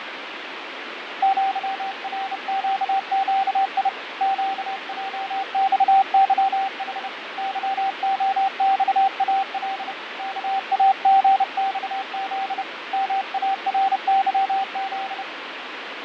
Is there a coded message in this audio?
Yes: Morse code (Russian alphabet) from 1.2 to 15.3 s, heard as a keyed tone, hand-sent with a bug key, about 30 wpm, 780 Hz, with radio static and fading. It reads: ЪРЩЩИ ЩЙЬЫХ ЫОЬАЛ КАГЬЗ МАРЫЗ